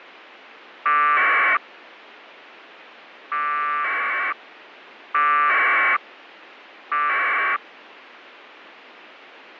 Packet radio (AX.25, as in APRS), 1200 baud, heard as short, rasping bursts.